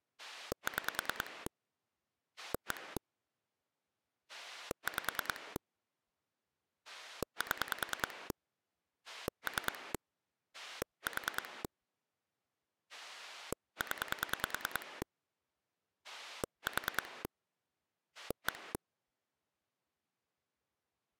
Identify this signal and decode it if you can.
Pulse dialling, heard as a rotary dial, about 10 pulses a second. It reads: 6 1 5 7 3 4 0 4 1